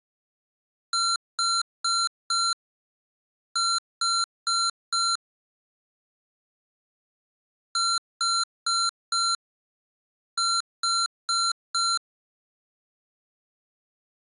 Beep code, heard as beeps from a small speaker, played twice, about 1370 Hz. 4-4.